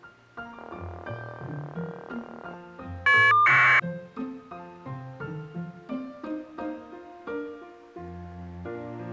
Caller ID data burst, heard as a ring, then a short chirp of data, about 1200 baud.